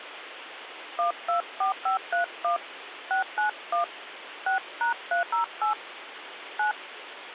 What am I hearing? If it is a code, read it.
DTMF, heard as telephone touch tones, dialled by hand, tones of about 120 ms, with phone line noise. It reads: 124531 691 6#308 9